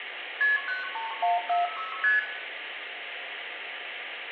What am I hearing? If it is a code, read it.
Multi-frequency trunk signalling (R1, as on North American trunks), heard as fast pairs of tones, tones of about 160 ms, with phone line noise and room echo. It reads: KP 93146 ST